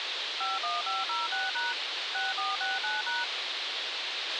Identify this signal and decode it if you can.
DTMF, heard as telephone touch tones, dialled by machine, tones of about 180 ms, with radio hiss and a squelch burst at the end. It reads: 51506# 6469#